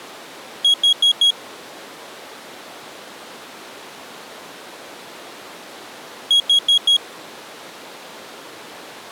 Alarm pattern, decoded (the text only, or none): temporal four